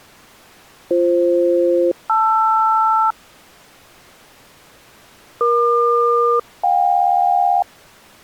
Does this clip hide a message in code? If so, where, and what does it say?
Yes: aircraft SELCAL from 0.9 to 7.6 s, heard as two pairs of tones. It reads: BF-LR EQ-JK